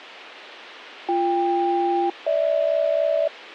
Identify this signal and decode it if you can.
Aircraft SELCAL, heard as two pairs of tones. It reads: BK-GH